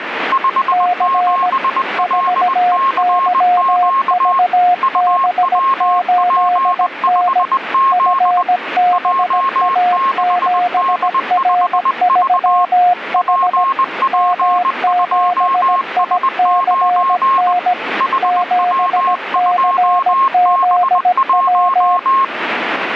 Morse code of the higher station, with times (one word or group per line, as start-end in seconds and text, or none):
0.3-4.4 57LCQ
4.8-8.4 UWP5Z
8.9-12.6 J6D5V
13.2-17.5 PP2S9
18.0-22.2 HW2B1